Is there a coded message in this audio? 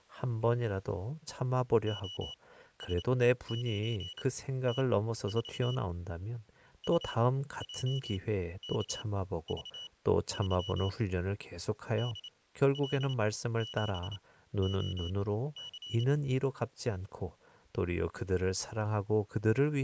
Yes: Morse code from 1.8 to 16.1 s, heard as a high beeper, machine-sent, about 28 wpm, spaced as for 14 wpm, 2950 Hz, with speech in Korean. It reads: OS9T4 UJKV3 DL7OC